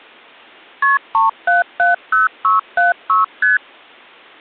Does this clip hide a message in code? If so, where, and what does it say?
Yes: multi-frequency trunk signalling (R1, as on North American trunks) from 0.8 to 3.6 s, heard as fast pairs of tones, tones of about 150 ms. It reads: KP 3770676 ST